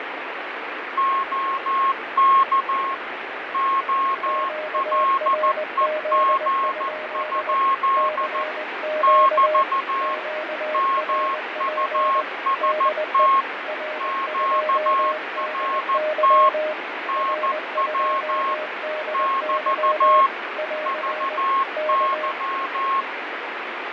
Morse code, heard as two keyed tones, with radio static and fading. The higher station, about 14 wpm, 1080 Hz: OK OLEG? <BT> MUST QRT NW <BT> VY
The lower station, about 20 wpm, 620 Hz: QRZ? CQ QRP DE R2DY R2DY <AR> K